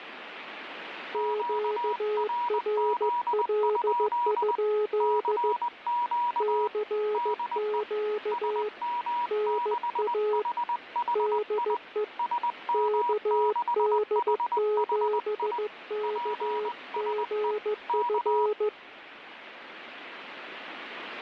Morse code, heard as two keyed tones, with radio static. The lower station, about 15 wpm, 420 Hz: QRL? CQ NA DE KD7KGF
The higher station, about 20 wpm, 960 Hz: QRZ? CQ DE SM6HHI SM6HHI PSE K